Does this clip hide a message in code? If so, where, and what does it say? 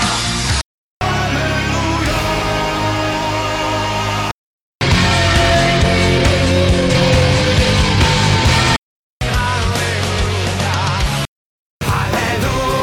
No.